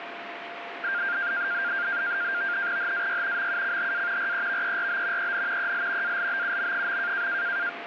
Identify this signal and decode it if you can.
NAVTEX (SITOR-B), 100 baud, 170 Hz shift, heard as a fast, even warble, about 1500 Hz centre, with radio static and a steady whistle near 690 Hz. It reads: HAY MUCHA REVERB EN EL ALBUM.